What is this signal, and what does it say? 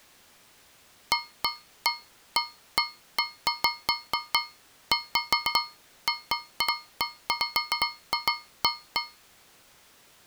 Irregular taps on a metal pipe. There is no code.